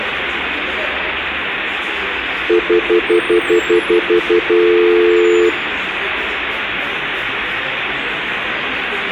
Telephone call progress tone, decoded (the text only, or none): stutter dial tone